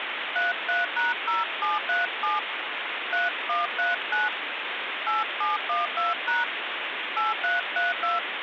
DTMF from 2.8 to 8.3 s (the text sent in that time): 3139 8712# 8332